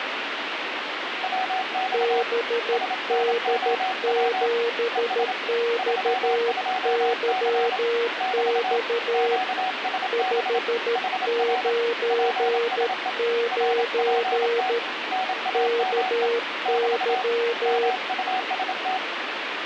Morse code, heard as two keyed tones, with radio static. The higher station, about 27 wpm, 750 Hz: WX SNOW ES 32C <BT> QSB HR PSE RPT NAME <BT> MUST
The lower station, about 13 wpm, 470 Hz: BD7XYX 599 KY